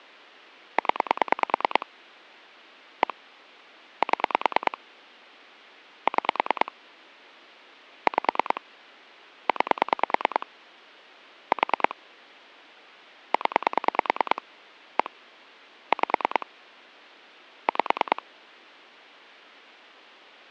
Pulse dialling, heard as clicks on a phone line, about 9 pulses a second. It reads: 0 1 7 6 5 9 4 0 1 5 5